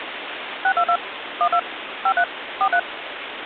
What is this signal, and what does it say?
DTMF, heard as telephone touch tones, dialled by machine, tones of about 70 ms, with phone line noise. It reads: 622 12 53 43